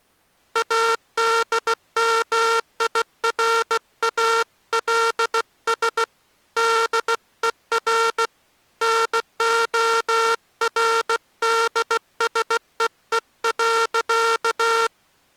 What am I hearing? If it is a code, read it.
Morse code, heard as a buzzer, hand-sent with a bug key, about 16 wpm. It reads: ADMIRALS DER NORDSEE.